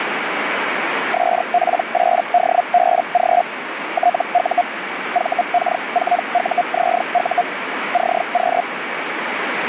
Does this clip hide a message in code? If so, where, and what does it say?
Yes: Hellschreiber (Feld-Hell, 122.5 baud) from 1.1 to 8.6 s, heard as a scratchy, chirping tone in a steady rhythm, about 710 Hz, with radio static. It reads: SP8DBG TU VK4UZU CQ